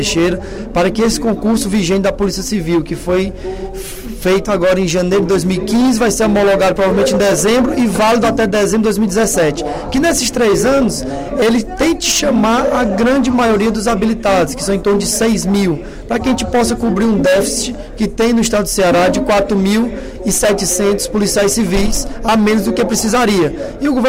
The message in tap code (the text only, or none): none